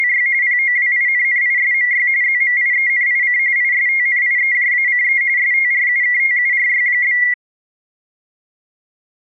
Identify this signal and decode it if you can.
RTTY (45.45 baud, 170 Hz shift), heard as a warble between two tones, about 2050 Hz centre. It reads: … POWINNISMY ZMIENIC ISTNIEJACE STRUKTURY?